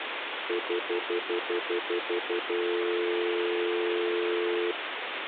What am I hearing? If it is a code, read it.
Telephone call progress tone (North American plan), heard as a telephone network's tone, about 350, 440 Hz, 0.1 s on and 0.1 s off, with phone line noise. Stutter dial tone.